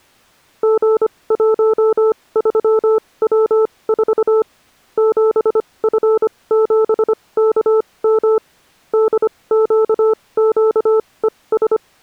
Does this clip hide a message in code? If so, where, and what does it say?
Yes: Morse code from 0.6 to 11.8 s, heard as a keyed tone, machine-sent, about 25 wpm, spaced as for 20 wpm, 440 Hz. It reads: G13W4 7F7KM DQQES